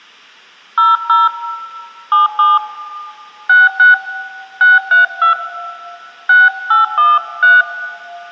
DTMF, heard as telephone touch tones, dialled by hand, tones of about 160 ms, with room echo. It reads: 00 77 66 632 6813